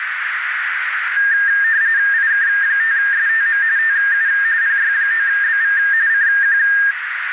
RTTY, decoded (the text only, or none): IK5STM TU PY9BV CQ